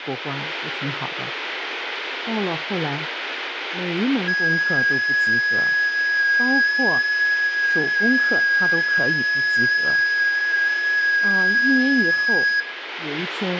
FT8 (one signal), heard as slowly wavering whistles, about 6.25 baud, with radio static, room echo and speech in Chinese.